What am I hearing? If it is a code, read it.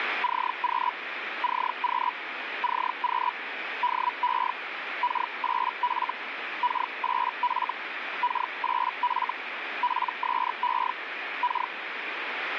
Hellschreiber (Feld-Hell, 122.5 baud), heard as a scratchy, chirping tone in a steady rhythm, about 980 Hz, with radio static. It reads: CQ CQ CQ DE K8F K8F K8F PSE K